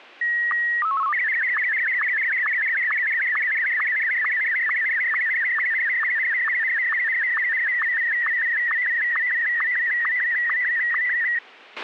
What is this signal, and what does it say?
SSTV (slow-scan television), Martin M1, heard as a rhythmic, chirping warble, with a squelch burst at the end.